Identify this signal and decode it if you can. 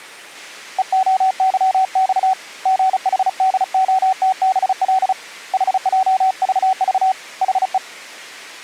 Morse code, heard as a keyed tone, hand-sent with a paddle, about 35 wpm, 760 Hz. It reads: EOYX GHDOTBL HJVV HE